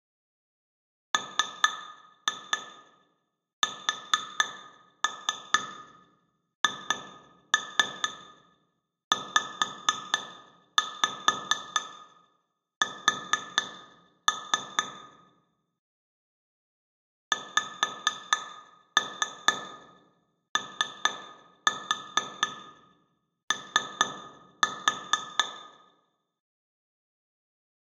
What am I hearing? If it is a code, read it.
Tap code, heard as taps on glass, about 4 knocks a second, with room echo. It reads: MSHZS XOO